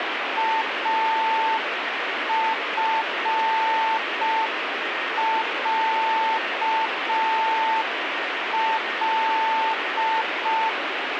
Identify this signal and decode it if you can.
Morse code (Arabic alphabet), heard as a keyed tone, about 5 wpm, 890 Hz, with radio static. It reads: افعل